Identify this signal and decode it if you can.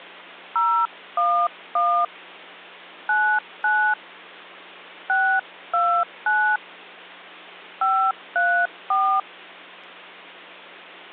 DTMF, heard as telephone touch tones, dialled by hand, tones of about 300 ms, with hum. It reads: 011 99 629 534